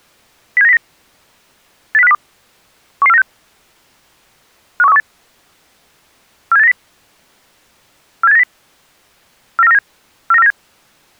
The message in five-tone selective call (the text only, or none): 07909 80502 11496 51318 47890 47890 49497 49497